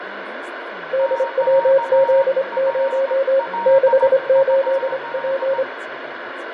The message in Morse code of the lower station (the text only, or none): DWZ0 68P